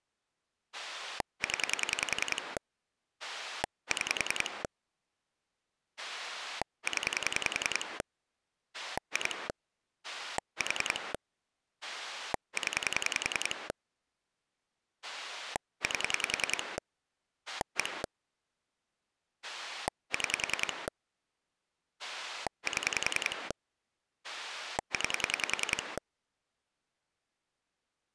Pulse dialling, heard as a rotary dial, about 10 pulses a second. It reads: 0 6 0 2 4 0 8 1 6 7 9